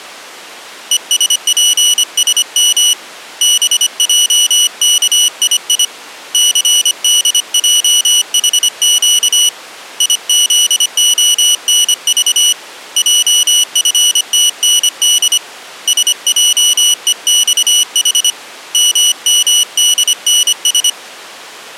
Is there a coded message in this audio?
Yes: Morse code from 0.9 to 21.0 s, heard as a high beeper, hand-sent with a paddle, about 25 wpm, 2950 Hz. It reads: ESPSM BJKII CDJHQ IZONV JFTND SJEXH MMDNS